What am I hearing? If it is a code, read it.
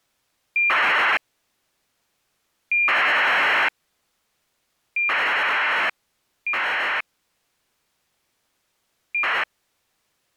ACARS aircraft data, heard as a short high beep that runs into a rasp, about 2400 baud.